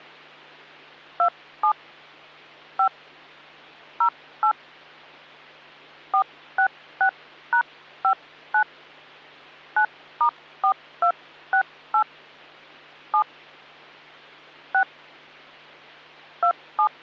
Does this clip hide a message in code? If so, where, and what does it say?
Yes: DTMF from 1.2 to 16.9 s, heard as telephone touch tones, dialled by hand, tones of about 80 ms, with hum. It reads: 27 5 08 466#59 9*4268 7 6 27